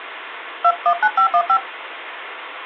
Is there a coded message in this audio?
Yes: DTMF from 0.6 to 1.6 s, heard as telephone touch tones, dialled by hand, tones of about 80 ms, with phone line noise. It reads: 219515